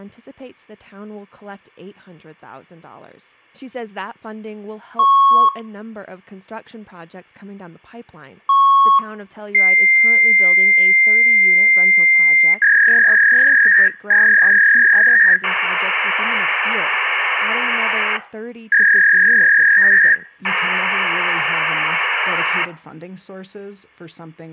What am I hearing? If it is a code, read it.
Fax machine handshake, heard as beeps, a long tone, a warble and hiss, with room echo and speech in English.